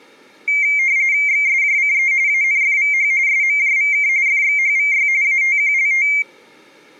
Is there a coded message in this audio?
Yes: RTTY (45.45 baud, 170 Hz shift) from 0.5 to 6.2 s, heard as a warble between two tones, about 2200 Hz centre. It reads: XSJCE ANFVH SMJVK FXHVY ATQLT